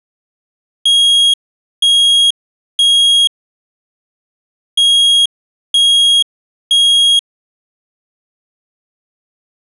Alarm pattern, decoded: temporal three

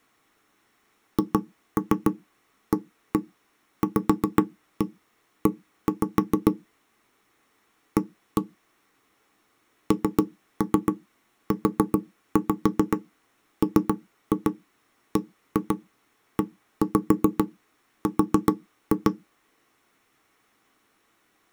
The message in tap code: HAVE A NUMBER

